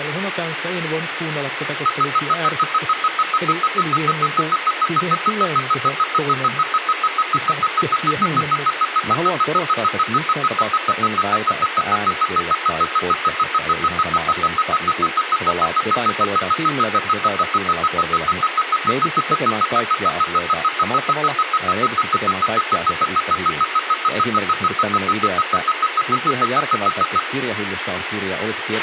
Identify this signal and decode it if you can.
Evenly repeated beeps, with radio hiss, a squelch burst at the end and speech in Finnish. There is no code.